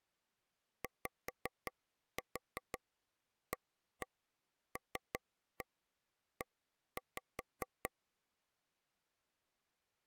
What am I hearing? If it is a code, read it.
Tap code, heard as taps on a table, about 5 knocks a second. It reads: YALE